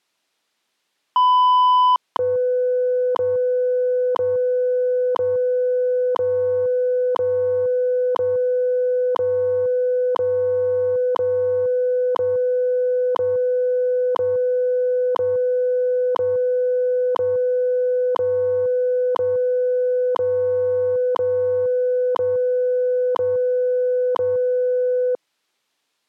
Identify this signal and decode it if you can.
Radio time signal (WWV, Colorado), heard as ticks, one a second.